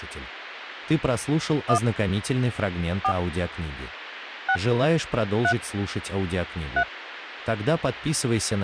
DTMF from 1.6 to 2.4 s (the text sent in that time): 1